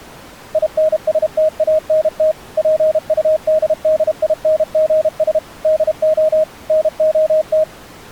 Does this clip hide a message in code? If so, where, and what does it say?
Yes: Morse code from 0.5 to 7.7 s, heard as a keyed tone, machine-sent, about 32 wpm, 630 Hz. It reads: INSTANT PUDDINGS DO NOT